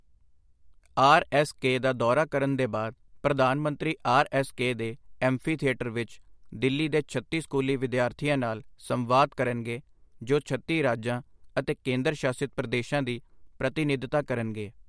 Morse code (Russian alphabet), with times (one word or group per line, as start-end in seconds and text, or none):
none